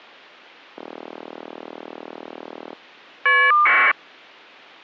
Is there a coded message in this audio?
Yes: caller ID data burst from 0.8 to 3.9 s, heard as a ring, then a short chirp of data, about 1200 baud.